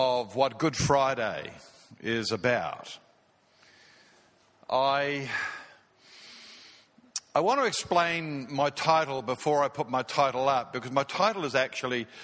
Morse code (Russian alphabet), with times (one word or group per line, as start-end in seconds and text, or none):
none